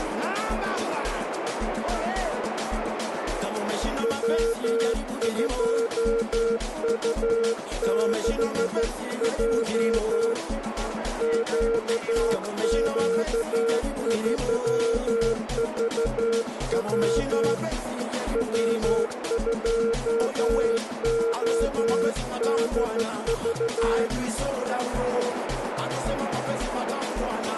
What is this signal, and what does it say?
Morse code, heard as a keyed tone, hand-sent with a straight key, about 13 wpm, 460 Hz, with radio static and a narrow filter. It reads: W2U6J QQ3VW W2ODV